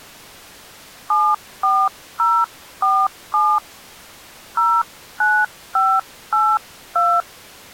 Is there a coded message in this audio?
Yes: DTMF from 1.1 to 7.2 s, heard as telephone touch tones, dialled by hand, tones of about 250 ms. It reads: 74047 09582